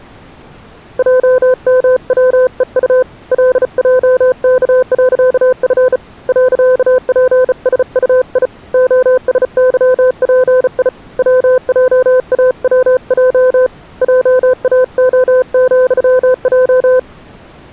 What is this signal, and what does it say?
Morse code, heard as a keyed tone, hand-sent with a bug key, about 35 wpm, 510 Hz. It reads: JMWEU LJK.F .PSUI OSYPI WJAWJ JAO,J